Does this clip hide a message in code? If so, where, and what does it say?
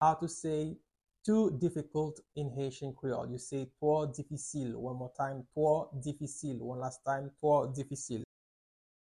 No.